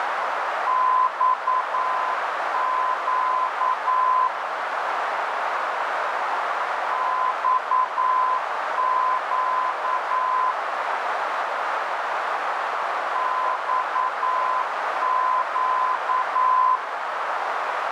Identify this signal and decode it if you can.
Morse code, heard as a keyed tone, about 9 wpm, 1020 Hz, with heavy radio static and a narrow filter. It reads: XQ XQ XQ